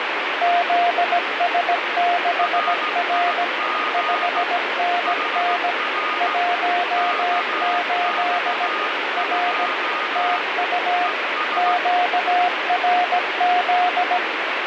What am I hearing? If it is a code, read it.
Morse code, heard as two keyed tones, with heavy radio static. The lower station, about 17 wpm, 710 Hz: ZS6R 5NN 18 R TU QRZ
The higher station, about 16 wpm, 1230 Hz: RIG HR KX2 ES